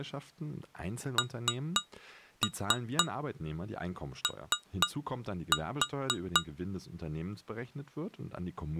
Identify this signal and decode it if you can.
Tap code, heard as taps on glass, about 4 knocks a second, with speech in German. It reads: NO